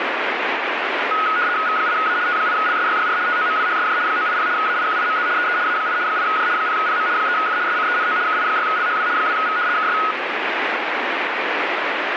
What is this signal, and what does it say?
RTTY (75 baud, 170 Hz shift), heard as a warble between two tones, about 1360 Hz centre, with radio static. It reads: V8A T8LSYYR TOMWHSJ 980 AIQIMZ EE A8 8J 0PM 3F SCENO KI6LHW 2V KS